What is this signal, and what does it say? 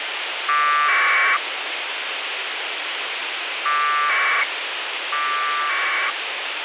Packet radio (AX.25, as in APRS), 1200 baud, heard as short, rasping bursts, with radio hiss.